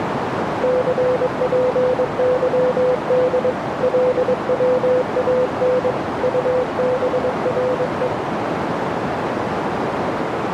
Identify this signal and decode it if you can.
Morse code, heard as a keyed tone, hand-sent with a paddle, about 22 wpm, 500 Hz, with heavy radio static and a narrow filter. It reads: CPYD LWAN UBRE